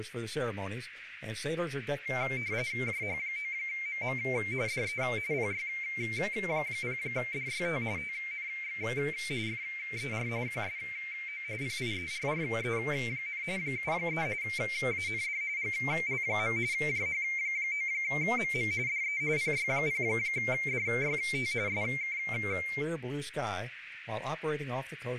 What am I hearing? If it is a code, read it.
RTTY (45.45 baud, 170 Hz shift), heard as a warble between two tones, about 2200 Hz centre, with radio static, a narrow filter and speech in English. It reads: JH9MM DE PY0DYT TNX FER QSO PIERRE, 73 AND GL. JH9MM DE PY0DYT SK